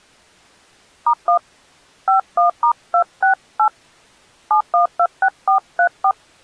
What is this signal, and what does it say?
DTMF, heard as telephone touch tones, dialled by hand, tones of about 100 ms. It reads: *1 51*268 7126434